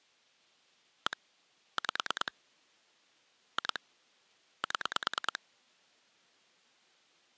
Pulse dialling, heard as clicks on a phone line, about 9 pulses a second. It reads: 1 5 2 7